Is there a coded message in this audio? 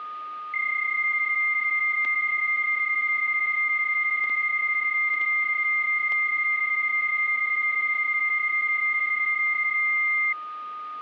Yes: PSK31 (31.25 baud) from 0.5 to 10.3 s, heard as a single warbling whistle, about 2100 Hz, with static crashes and a steady whistle near 1230 Hz.